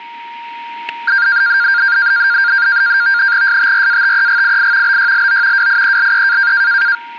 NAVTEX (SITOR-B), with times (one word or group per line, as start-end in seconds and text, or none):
3.5-5.0 STRATEGII
4.9-5.7 BYLO
5.6-6.5 WIELE